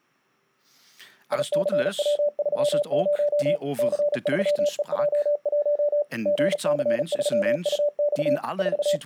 Morse code, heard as a keyed tone, machine-sent, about 36 wpm, 590 Hz, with speech in Dutch. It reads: ICW30 C3EJ1 GC3UX …